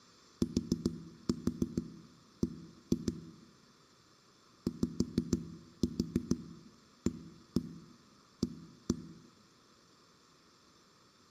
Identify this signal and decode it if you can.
Tap code, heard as knocks on a wall, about 6 knocks a second, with room echo. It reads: TB YAA